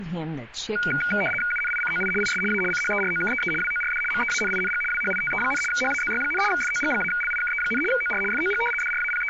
RTTY (75 baud, 850 Hz shift), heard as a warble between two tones, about 1850 Hz centre. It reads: UNICOI IS A CHEROKEE WORD MEANING WHITE, HAZY, FOG-LIKE, OR FOG …